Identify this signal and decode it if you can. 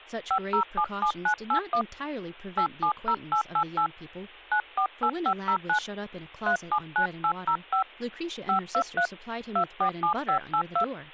DTMF, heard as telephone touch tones, dialled by hand, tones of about 80 ms, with speech in English. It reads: 5077981 870888 948509 379805 523 247582